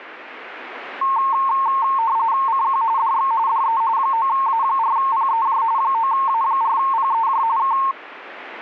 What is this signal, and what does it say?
RTTY (45.45 baud, 170 Hz shift), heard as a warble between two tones, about 990 Hz centre. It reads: CQ DX DE 9A4PEJ 9A4PEJ K